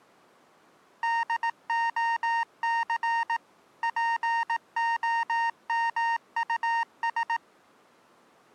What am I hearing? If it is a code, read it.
Morse code, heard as electronic beeps, machine-sent, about 18 wpm, 920 Hz. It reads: DOC POMUS